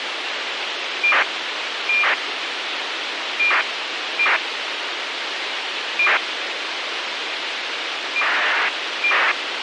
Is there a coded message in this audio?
Yes: ACARS aircraft data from 1.0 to 9.3 s, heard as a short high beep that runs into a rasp, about 2400 baud, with radio hiss.